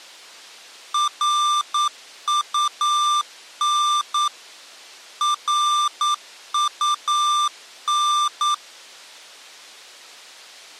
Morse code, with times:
0.9-4.3 RUN
5.2-8.5 RUN

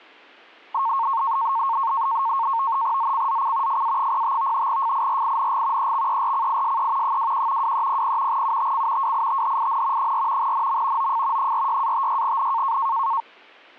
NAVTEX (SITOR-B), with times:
3.0-3.8 ZCZC
3.7-4.7 FA05
4.7-5.9 FIRING
5.8-7.2 EXERCISE
7.0-7.7 21
7.6-8.4 2300
8.3-9.1 UTC
9.0-10.1 WITHIN
10.0-10.5 4
10.4-11.1 NM
11.0-11.5 OF
11.4-12.8 46-56N

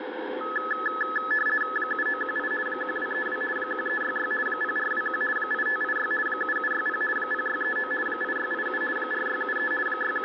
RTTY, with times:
1.8-2.5 7918
2.7-3.4 1232
3.6-4.3 1366
4.5-5.2 0421
5.4-6.1 8586
6.3-7.0 7760
7.2-7.9 0639
8.1-8.8 8687
9.0-9.7 4673
9.9-10.3 …

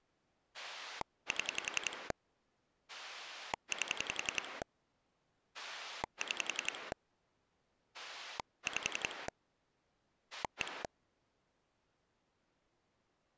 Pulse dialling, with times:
0.5-2.1 7
2.9-4.6 8
5.5-6.9 6
7.9-9.3 5
10.3-10.8 1

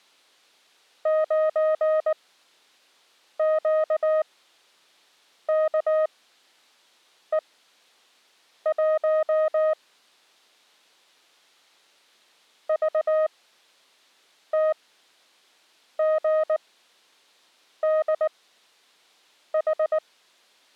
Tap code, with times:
none

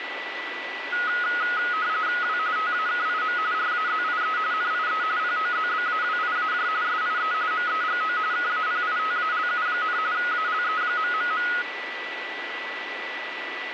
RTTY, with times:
2.2-2.4 W
2.6-3.4 TAKIM
3.5-4.4 RAZIE
4.5-5.0 NIE
5.2-6.7 POZBAWIAJ
6.8-7.3 SIE
7.5-8.2 MEGO
8.3-10.0 KAPITALU,
10.1-11.5 ALE...

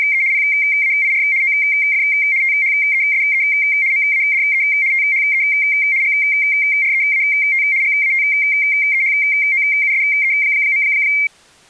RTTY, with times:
0.0-0.2 …
0.3-1.2 PAIR
1.4-2.0 OF
2.4-3.4 THESE
3.9-4.6 MADE
4.9-5.4 THE
6.0-7.6 GREAT
7.8-10.8 GATEHOUSE.

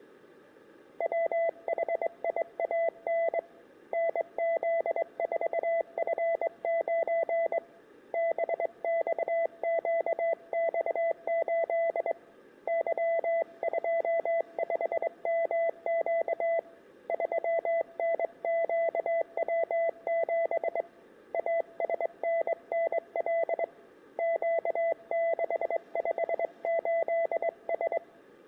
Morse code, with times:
1.0-3.4 WHIAN
3.9-7.6 NZ4F9
8.1-12.1 BXQX8
12.7-16.6 Y25MQ
17.1-20.8 3NQW7
21.3-23.6 ASNNL
24.2-28.0 Q658S

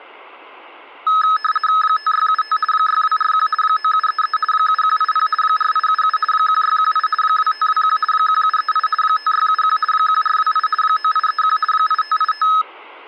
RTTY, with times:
1.8-2.6 5675
2.7-3.5 6241
3.6-4.4 9733
4.5-5.3 7180
5.4-6.2 4877
6.3-7.1 1618
7.2-8.0 2521
8.1-8.9 1738
9.0-9.8 5671
9.9-10.7 1428
10.8-11.6 9831
11.7-12.5 8585

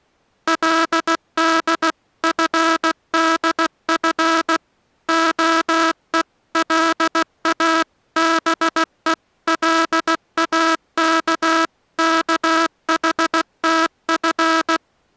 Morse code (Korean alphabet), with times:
0.5-4.6 그는
5.1-14.8 파고다공원

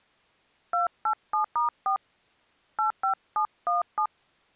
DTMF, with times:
0.7-2.0 287*4
2.8-4.1 85717

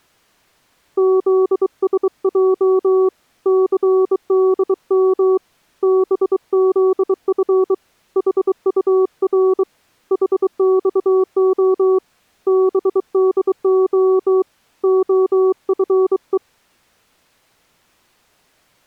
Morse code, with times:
1.0-3.1 ZSJ
3.5-5.4 CDM
5.8-7.7 BZF
8.2-9.6 HUR
10.1-12.0 HXO
12.5-14.4 BDO
14.8-16.4 OFE

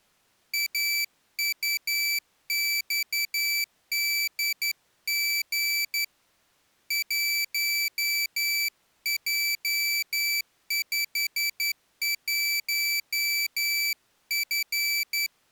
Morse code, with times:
0.5-6.0 AUXDG
6.9-15.3 1J51F

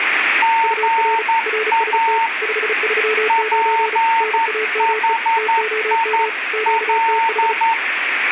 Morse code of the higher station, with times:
0.4-2.3 GA
3.3-7.7 PHIL

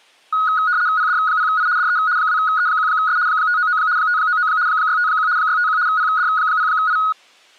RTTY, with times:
1.0-1.7 PD0I
1.8-2.0 DE
2.2-3.2 2E1S
3.3-3.8 599
4.0-4.5 599
4.7-5.3 651
5.4-5.8 651
5.9-7.0 PD0I

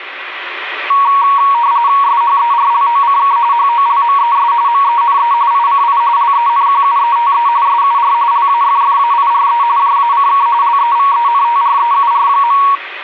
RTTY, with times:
2.0-3.4 SHERLOCK
3.5-4.5 HOLMES
4.7-5.3 MENE
5.5-6.0 ICI
6.2-7.5 LENQUETE
7.7-8.1 SUR
8.3-9.6 LAFFAIRE
9.8-10.5 JACK
10.6-12.6 LEVENTREUR.

